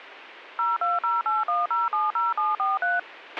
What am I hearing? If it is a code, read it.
DTMF, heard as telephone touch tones, dialled by machine, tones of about 180 ms, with a squelch burst at the end. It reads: 02081070743